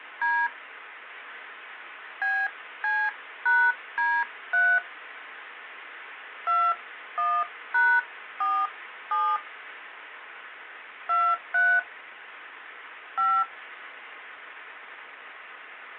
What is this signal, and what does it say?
DTMF, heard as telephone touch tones, dialled by hand, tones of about 250 ms, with phone line noise. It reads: D BC#D3 21#47 23 5